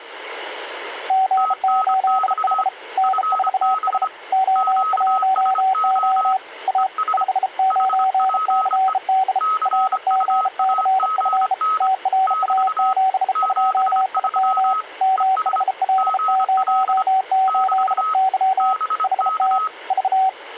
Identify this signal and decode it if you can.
Morse code, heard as two keyed tones. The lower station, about 33 wpm, 760 Hz: G8H N4S O1O A 59CD RGCF TRA72IM MHL08Y HT V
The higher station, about 25 wpm, 1280 Hz: TNX FB QSO ES HPE CUAGN <BT> 73 ES GL <BT> BK